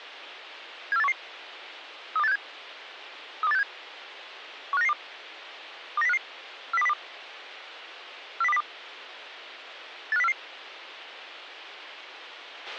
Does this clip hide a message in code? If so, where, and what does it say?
Yes: five-tone selective call (EEA) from 0.9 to 10.3 s, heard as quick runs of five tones, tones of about 40 ms, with a squelch burst at the end. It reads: 74811 32867 32867 15992 29055 40202 40202 85044